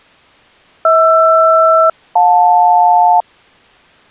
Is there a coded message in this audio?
Yes: aircraft SELCAL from 0.8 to 3.2 s, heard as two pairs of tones. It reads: HR-JL